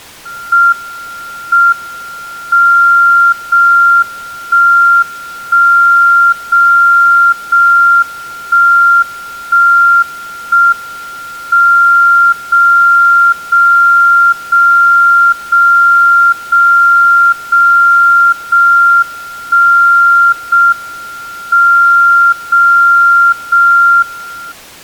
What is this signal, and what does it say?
Radio time signal (JJY), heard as a tone whose level steps once a second, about 1390 Hz. The time is 02:37 Japan time. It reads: M M 0 1 1 0 0 1 1 1 M 0 0 0 0 0 0 0 1 0 M 0 0 1